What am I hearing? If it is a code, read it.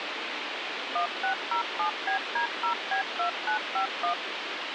DTMF, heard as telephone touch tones, dialled by machine, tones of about 100 ms, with radio hiss and a squelch burst at the end. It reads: 1607BD0B2951